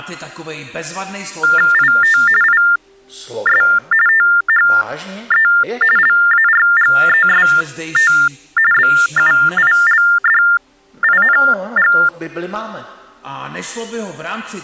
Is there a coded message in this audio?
Yes: TTY/TDD text telephone tones (45.45 baud Baudot) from 1.4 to 12.1 s, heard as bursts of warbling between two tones, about 400 Hz shift, 1600 Hz centre. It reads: IT IS THE LARGEST BUILDING